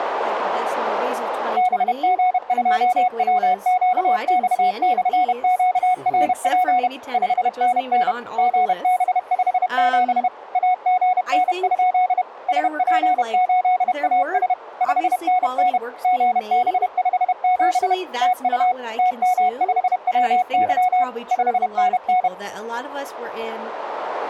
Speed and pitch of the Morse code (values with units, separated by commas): 31 wpm, 730 Hz